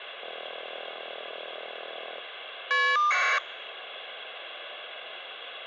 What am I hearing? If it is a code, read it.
Caller ID data burst, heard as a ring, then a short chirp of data, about 1200 baud, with phone line noise.